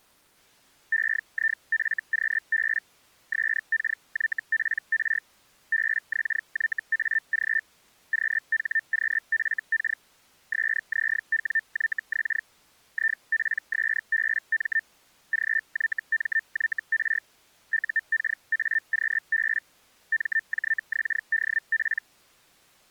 Hellschreiber (Feld-Hell, 122.5 baud), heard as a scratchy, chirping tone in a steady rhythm, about 1800 Hz. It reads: EIFQB SKYPR BXYAG QHQFK SZWYX IPSBM GYMYR UKAQB MJXDP